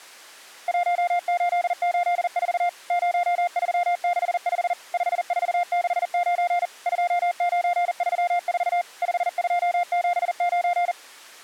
Morse code, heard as a keyed tone, machine-sent, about 40 wpm, 700 Hz. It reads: 1884 0365 5469 2934 5279